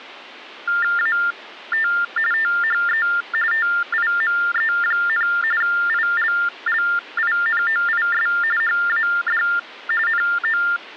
TTY/TDD text telephone tones (45.45 baud Baudot), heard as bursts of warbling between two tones, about 400 Hz shift, 1600 Hz centre. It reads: AT THE TIME, ILLINOIS HAD NO